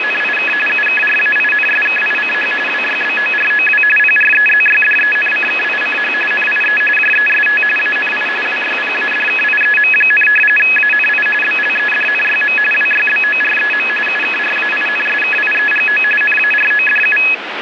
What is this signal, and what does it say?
RTTY (45.45 baud, 850 Hz shift), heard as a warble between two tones, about 2100 Hz centre, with radio static. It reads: … UKRAINSKICH WYBOROW PREZYDENCKICH NIE JEST ANI WYPADKIEM, ANI BLEDNYM WYBOREM UKRAINSKIEGO NARODU